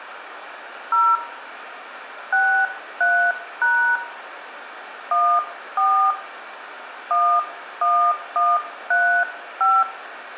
DTMF, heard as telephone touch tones, dialled by hand, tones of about 290 ms, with radio hiss and room echo. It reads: 0 63# 14 11135